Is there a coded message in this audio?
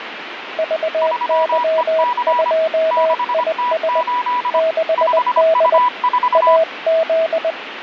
Yes: Morse code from 0.5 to 7.6 s, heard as two keyed tones, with radio static. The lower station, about 20 wpm, 640 Hz: VY2IS 6D AZ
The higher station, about 25 wpm, 980 Hz: 3EC 6T8 5U4